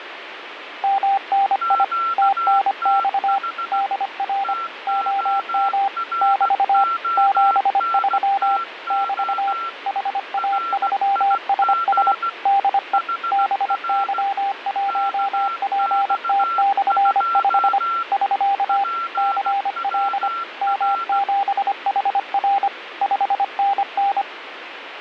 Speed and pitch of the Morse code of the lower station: 25 wpm, 790 Hz

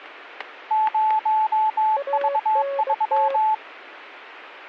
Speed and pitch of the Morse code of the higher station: 22 wpm, 870 Hz

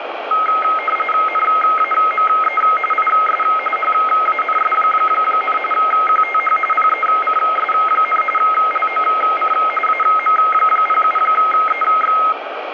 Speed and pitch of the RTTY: 45.45 baud, 850 Hz shift, 1700 Hz centre

